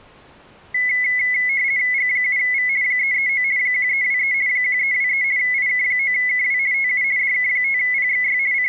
RTTY (50 baud, 170 Hz shift), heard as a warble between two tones, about 2100 Hz centre. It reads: G7V 339 1323 1323 IK9KW TU DK5PXY …